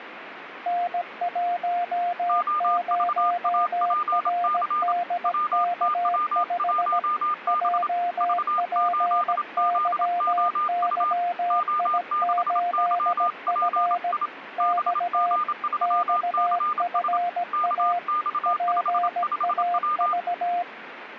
Morse code, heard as two keyed tones, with radio static. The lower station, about 17 wpm, 700 Hz: N10RDK5 JPYYI8F X XFA PAV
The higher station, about 27 wpm, 1210 Hz: OVAPC WTW1B V8ZOU O6YPI BG3CS KX55W